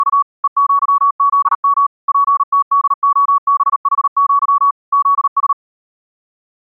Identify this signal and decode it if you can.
Morse code (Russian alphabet), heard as a keyed tone, machine-sent, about 38 wpm, 1130 Hz. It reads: … ЕЪЗМ ПТДОБХЪ ЗС